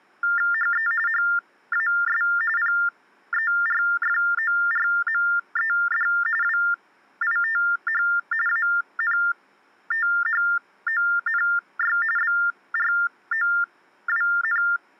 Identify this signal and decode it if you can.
TTY/TDD text telephone tones (45.45 baud Baudot), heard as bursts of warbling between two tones, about 400 Hz shift, 1600 Hz centre. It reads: HE HAS PERFORMED WITH ANTHONY BROWN